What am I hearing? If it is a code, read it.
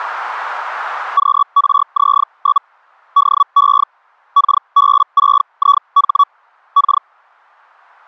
Hellschreiber (Feld-Hell, 122.5 baud), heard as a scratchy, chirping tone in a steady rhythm, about 1130 Hz. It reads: QRZ? DE KB6IH K